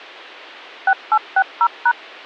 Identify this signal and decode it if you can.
DTMF, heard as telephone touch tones, dialled by machine, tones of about 60 ms. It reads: 6860#